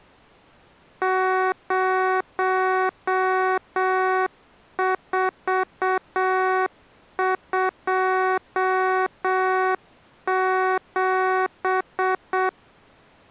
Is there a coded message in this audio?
Yes: Morse code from 1.0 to 12.6 s, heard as electronic beeps, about 7 wpm, 370 Hz. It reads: 0427